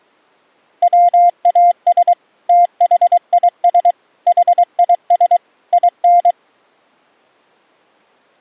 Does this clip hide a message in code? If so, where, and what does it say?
Yes: Morse code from 0.8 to 6.4 s, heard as a keyed tone, machine-sent, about 23 wpm, 700 Hz. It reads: WAS THIS HIS IN